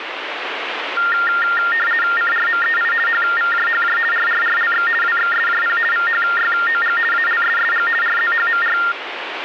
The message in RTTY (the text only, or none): CRMEI HVJHJ RRRLX WXSJP VHYOG ALSSG RZHMR